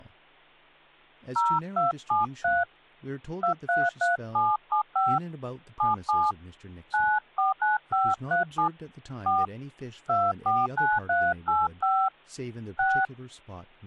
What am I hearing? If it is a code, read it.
DTMF, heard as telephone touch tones, dialled by hand, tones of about 180 ms, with hum and speech in English. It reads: 0273 233775 77 949537 4 249385 6